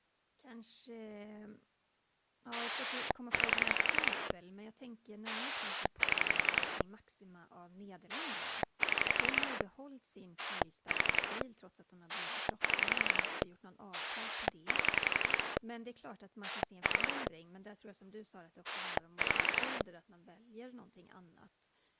Pulse dialling, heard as a rotary dial, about 11 pulses a second, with speech in Swedish. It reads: 9 7 7 4 7 8 3 5